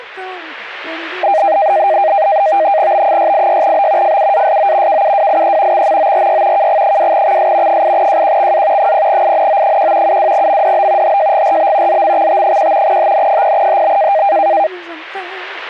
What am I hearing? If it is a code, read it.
NAVTEX (SITOR-B), 100 baud, 170 Hz shift, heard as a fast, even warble, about 710 Hz centre. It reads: B686B FUASO KUWIE XMORY KG2XS 8JQXA 0INO1 72MDB HJGRB ZMXT1 HN0HB